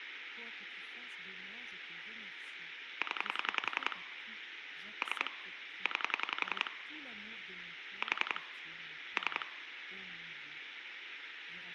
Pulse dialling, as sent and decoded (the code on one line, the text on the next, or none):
10 / 3 / 9 / 4 / 3
0 3 9 4 3